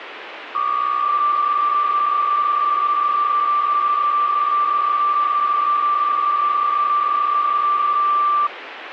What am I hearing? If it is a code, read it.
PSK63 (62.5 baud), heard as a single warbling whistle, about 1180 Hz, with radio static.